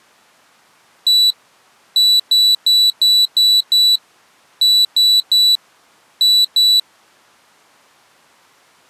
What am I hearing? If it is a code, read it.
Beep code, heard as a piezo beeper, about 3950 Hz. 1-6-3-2.